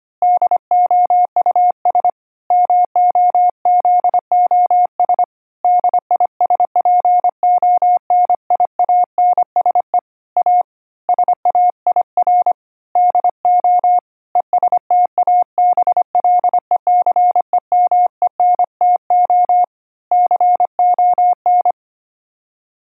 Morse code, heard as a keyed tone, hand-sent with a paddle, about 25 wpm, 720 Hz. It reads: DOUS MOZOS DISPONIANSE A SAIR DO ESTABLECEMENTO CON